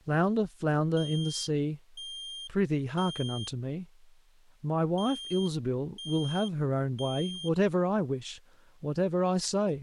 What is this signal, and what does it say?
Alarm pattern, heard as an alarm's beeps, played twice, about 3200 Hz, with speech in English. Temporal three. Smoke or fire, evacuate.